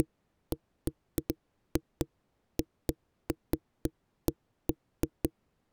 Irregular knocks on a wall. There is no code.